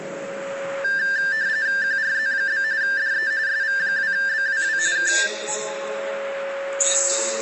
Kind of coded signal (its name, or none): RTTY